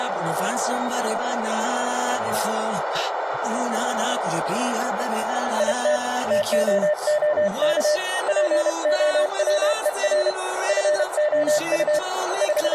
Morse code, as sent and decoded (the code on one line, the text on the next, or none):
.. - / - --- --- -.- / .--. --- .-- . .-. / ..-. --- ..- / …
IT TOOK POWER FOU …